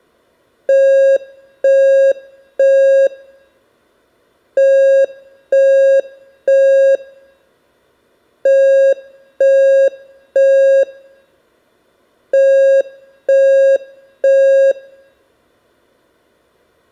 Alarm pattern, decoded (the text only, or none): temporal three